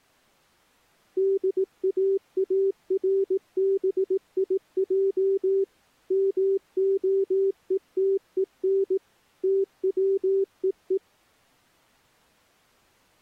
Morse code, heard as a keyed tone, machine-sent, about 18 wpm, 390 Hz. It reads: DAARBIJ MOETEN TWEE